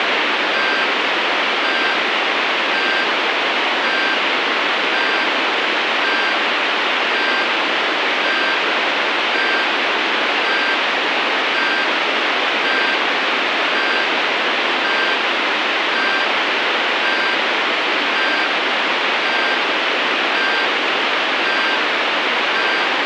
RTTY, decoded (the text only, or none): none